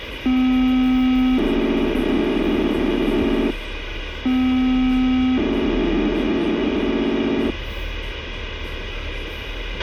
POCSAG pager data (512 baud), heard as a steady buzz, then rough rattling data, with radio hiss, a squelch burst at the end and the noise inside a car.